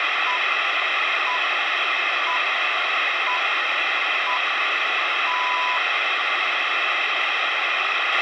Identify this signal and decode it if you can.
Radio time signal (six pips, as the Greenwich Time Signal), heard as pips, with radio hiss and a squelch burst at the end.